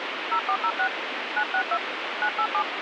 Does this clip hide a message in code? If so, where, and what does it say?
Yes: DTMF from 0.3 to 2.6 s, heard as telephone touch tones, dialled by hand, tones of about 70 ms, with radio hiss. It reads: 0406 962 987